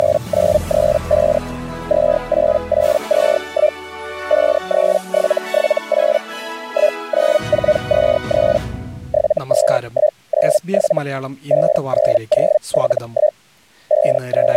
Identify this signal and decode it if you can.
Hellschreiber (Feld-Hell, 122.5 baud), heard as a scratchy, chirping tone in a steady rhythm, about 610 Hz. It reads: … 28821 53778 19423 72197 59071 …